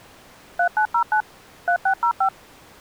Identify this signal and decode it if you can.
DTMF, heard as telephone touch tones, dialled by machine, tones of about 90 ms. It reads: 3909 3605